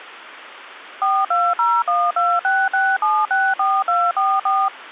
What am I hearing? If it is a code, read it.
DTMF, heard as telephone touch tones, dialled by machine, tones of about 230 ms. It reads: 4201266764244